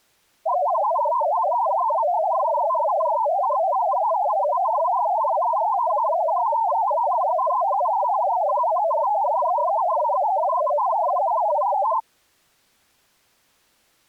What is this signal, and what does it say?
Multi-tone FSK (Olivia or MFSK type), about 500 Hz wide, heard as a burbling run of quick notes, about 62.5 baud.